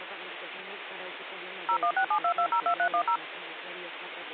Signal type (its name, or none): DTMF